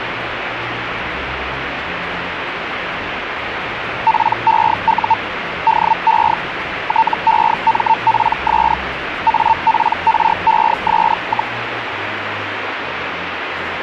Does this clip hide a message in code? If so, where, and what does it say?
Yes: Hellschreiber (Feld-Hell, 122.5 baud) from 4.1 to 11.5 s, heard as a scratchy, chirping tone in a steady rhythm, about 900 Hz, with radio static. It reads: PEU DE TEMPS APRES,